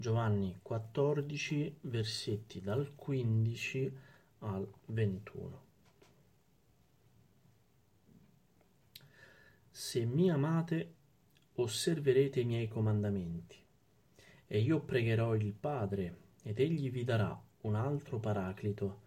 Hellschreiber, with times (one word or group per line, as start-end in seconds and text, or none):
none